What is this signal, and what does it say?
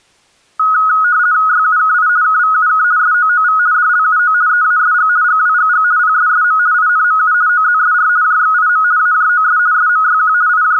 RTTY (50 baud, 170 Hz shift), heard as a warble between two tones, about 1360 Hz centre. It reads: YUKI KVUK SOOV DLUO EASG GWGG PSSM INMU OZSR JXIM AJOS SMYQ …